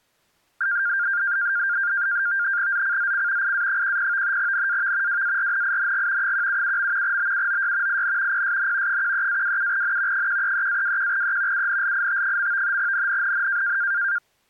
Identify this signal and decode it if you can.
NAVTEX (SITOR-B), 100 baud, 170 Hz shift, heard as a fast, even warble, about 1500 Hz centre. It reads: ZCZC IA10 NAV WARNING 177. BUOY IN PSN 13-27N 133-21E UNLIT. NNNN